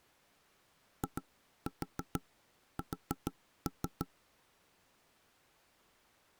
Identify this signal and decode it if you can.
Tap code, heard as knocks on wood, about 6 knocks a second. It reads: IS